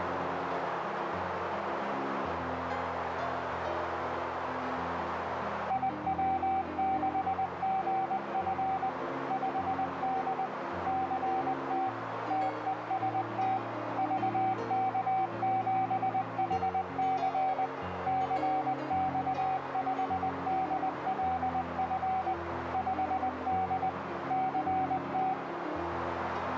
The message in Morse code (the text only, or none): IW6GF 5D CT TEST VK7HC CX5DLF 5D CT